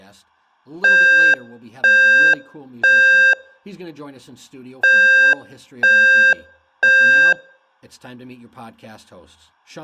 Alarm pattern, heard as an alarm's beeps, played twice, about 530 Hz, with room echo and speech in English. Temporal three. Smoke or fire, evacuate.